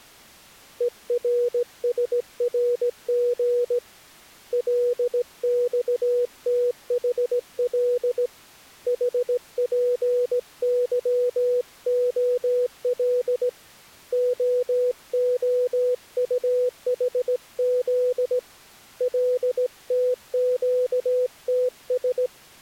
Morse code, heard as a keyed tone, hand-sent with a straight key, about 17 wpm, 490 Hz. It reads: ERSRG LXTHL HPYOL OOUHZ LTQTS